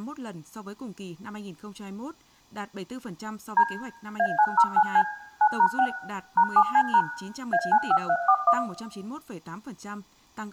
DTMF, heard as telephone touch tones, dialled by machine, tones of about 70 ms, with room echo and speech in Vietnamese. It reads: D A909C 9#6 #7C# A95341